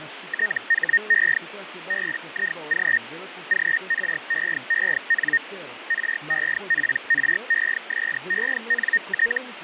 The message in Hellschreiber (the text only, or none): THE BIG GREEN REPRESENT